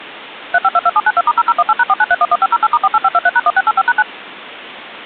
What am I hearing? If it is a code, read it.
DTMF, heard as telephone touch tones, dialled by machine, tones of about 40 ms. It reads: 3522792*0018#49311508*48523#1685#9